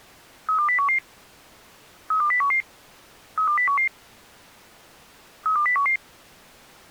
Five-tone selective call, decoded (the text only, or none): 32011 32011 32011 32011